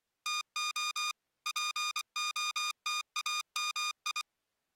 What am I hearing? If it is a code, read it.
Morse code (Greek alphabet), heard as electronic beeps, machine-sent, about 24 wpm, 1220 Hz. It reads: ΤΟ ΠΟΤΑΜΙ